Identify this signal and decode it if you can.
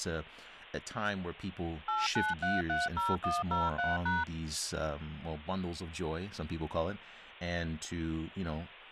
DTMF, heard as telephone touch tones, dialled by machine, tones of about 190 ms, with speech in English. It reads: 89330103#